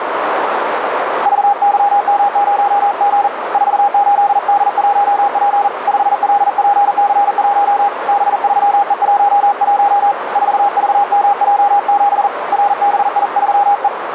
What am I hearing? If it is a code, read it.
Morse code, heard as a keyed tone, hand-sent with a paddle, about 40 wpm, 810 Hz, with radio static and a narrow filter. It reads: VYM0G 48D1P 5LPC1 B3E11 4VMJ7 RBI3E